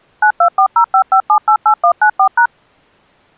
DTMF, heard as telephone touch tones, dialled by machine, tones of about 80 ms. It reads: 924055788194#